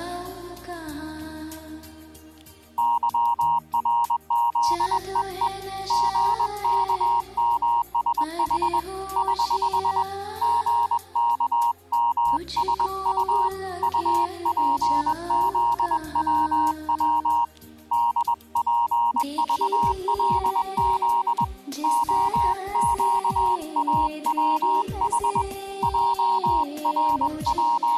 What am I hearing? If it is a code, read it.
Morse code, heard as a keyed tone, hand-sent with a paddle, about 21 wpm, 940 Hz. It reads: YRZEE GKMSH <HH> GKMSU UPZWW DPVLZ OQAWH …